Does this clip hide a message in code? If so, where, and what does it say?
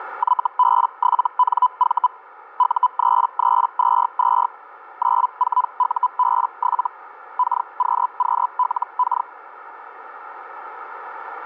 Yes: Hellschreiber (Feld-Hell, 122.5 baud) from 0.2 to 9.3 s, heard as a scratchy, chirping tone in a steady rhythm, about 1000 Hz, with radio static. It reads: YB7NV U3322 94UB7 KQQLK